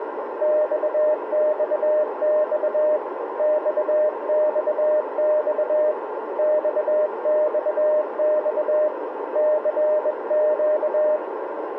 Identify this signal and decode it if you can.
Morse code, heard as a keyed tone, hand-sent with a bug key, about 21 wpm, 610 Hz, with radio static and a narrow filter. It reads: XXX XXX XXX CQ